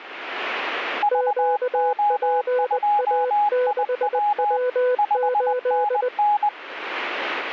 Morse code, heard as two keyed tones. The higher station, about 20 wpm, 830 Hz: VO2IW 5NN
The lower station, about 20 wpm, 500 Hz: QPA6W8